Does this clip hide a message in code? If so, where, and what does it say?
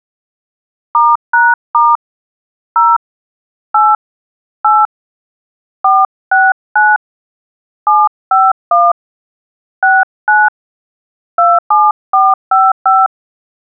Yes: DTMF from 0.9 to 13.1 s, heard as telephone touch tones, dialled by hand, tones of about 210 ms. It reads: *#* 0 8 8 469 751 69 27455